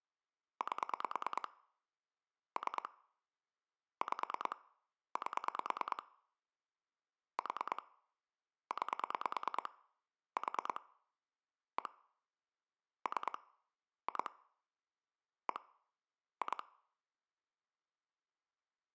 Pulse dialling, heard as clicks on a phone line, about 9 pulses a second. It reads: 8 3 5 8 4 9 4 1 3 2 1 2